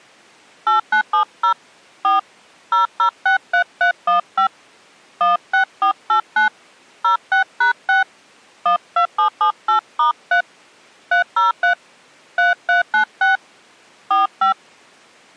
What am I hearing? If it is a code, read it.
DTMF, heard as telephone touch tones, dialled by hand, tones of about 120 ms. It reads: 8970 4 0063315 16489 06#6 12778*3 303 3396 45